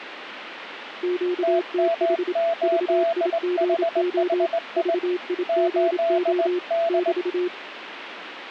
Morse code, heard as two keyed tones, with radio static. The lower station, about 27 wpm, 360 Hz: QTH VIGO VIGO <BT>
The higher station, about 19 wpm, 670 Hz: TM8HHI 8D